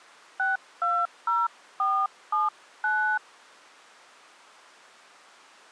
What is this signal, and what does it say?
DTMF, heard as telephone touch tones, dialled by hand, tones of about 240 ms. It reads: 620479